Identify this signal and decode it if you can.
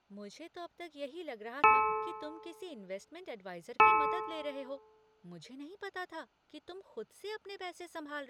Clock strike, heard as a bell, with speech in Hindi. 2. Two o'clock.